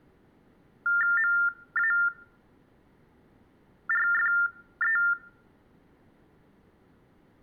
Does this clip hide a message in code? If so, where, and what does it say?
Yes: TTY/TDD text telephone tones (45.45 baud Baudot) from 0.9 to 5.1 s, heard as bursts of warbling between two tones, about 400 Hz shift, 1600 Hz centre. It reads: MARFE